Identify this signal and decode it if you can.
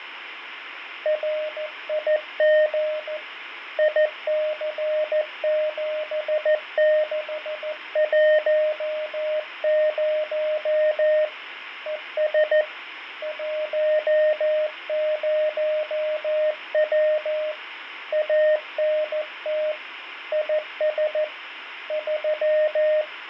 Morse code, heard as a keyed tone, hand-sent with a paddle, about 14 wpm, 610 Hz, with radio static and fading. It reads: RIG IC7610 ES 10W ANT IS 3